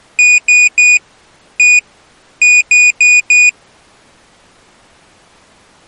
Beep code, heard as a piezo beeper, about 2450 Hz. 3-1-4. In Phoenix BIOS tables: interrupt mask register failure.